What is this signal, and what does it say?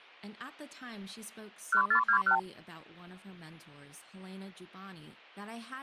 Multi-frequency trunk signalling (R2, with the far end's replies), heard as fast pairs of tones, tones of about 90 ms, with speech in English. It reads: 1421